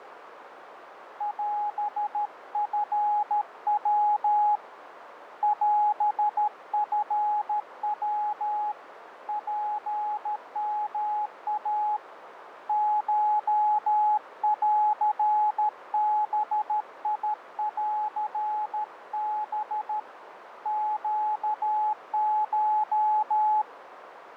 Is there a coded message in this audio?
Yes: Morse code (Japanese Wabun code) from 1.1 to 23.7 s, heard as a keyed tone, hand-sent with a paddle, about 13 wpm, 840 Hz, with radio static and a narrow filter. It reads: オチヤ オチヤ ツヨイ コンバンハ ネコ